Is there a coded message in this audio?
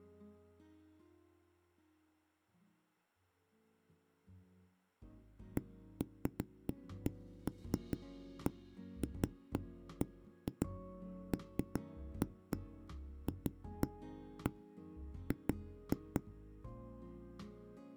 No, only irregular knocks on a wall.